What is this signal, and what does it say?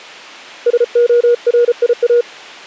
Morse code, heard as a keyed tone, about 34 wpm, 480 Hz. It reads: SORIA